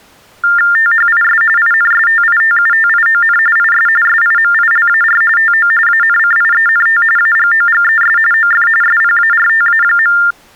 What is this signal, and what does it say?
TTY/TDD text telephone tones (45.45 baud Baudot), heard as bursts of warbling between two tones, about 400 Hz shift, 1600 Hz centre. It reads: THIS INSTITUTION IS SIMILAR TO ANCIENT AGOGES OF SPARTA.